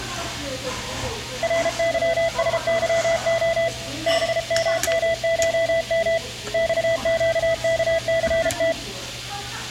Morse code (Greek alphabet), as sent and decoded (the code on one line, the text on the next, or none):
.-. -.-- ... -.-- --- / -... -- -- ---- -- / -..- --.- -.- -.-. -
ΡΥΣΥΟ ΒΜΜΧΜ ΞΨΚΘΤ